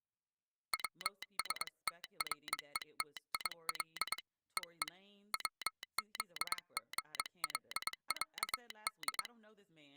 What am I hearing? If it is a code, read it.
Morse code (Russian alphabet), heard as a telegraph sounder, hand-sent with a paddle, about 22 wpm, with speech in English. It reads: ВСТРЕТИЛ ЕЕ ВЗГЛЯД